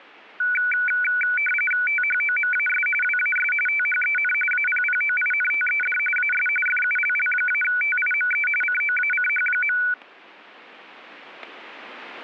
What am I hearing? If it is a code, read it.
RTTY (45.45 baud, 850 Hz shift), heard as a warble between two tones, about 1900 Hz centre, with static crashes. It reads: THOMAS WAS THEN APPOINTED AS FULL-TIME COACH.